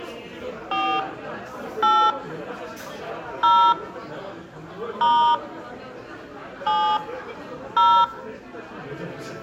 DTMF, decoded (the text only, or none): 4 8 0 * 7 0